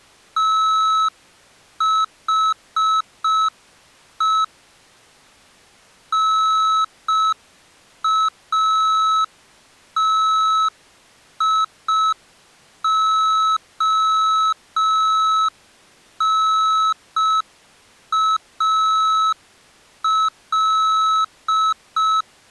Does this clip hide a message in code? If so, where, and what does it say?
Yes: Morse code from 0.3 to 22.3 s, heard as electronic beeps, machine-sent, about 5 wpm, 1300 Hz. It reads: THE NATIONAL